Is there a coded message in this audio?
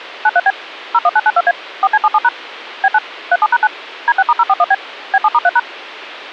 Yes: DTMF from 0.2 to 5.6 s, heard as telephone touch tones, dialled by machine, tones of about 50 ms. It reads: 93B 01992A 4C77# B9 37#9 D6*041B B7*3#